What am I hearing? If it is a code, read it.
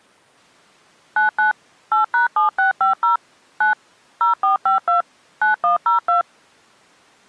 DTMF, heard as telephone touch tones, dialled by machine, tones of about 130 ms. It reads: 99 8#7650 9 0452 9102